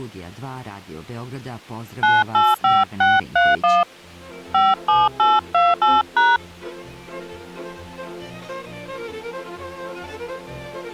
DTMF, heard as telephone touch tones, dialled by hand, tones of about 200 ms. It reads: 985631 57828#